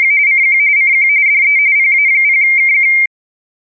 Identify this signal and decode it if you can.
RTTY (45.45 baud, 170 Hz shift), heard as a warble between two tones, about 2200 Hz centre. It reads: … CQ CQ DE PA0KQ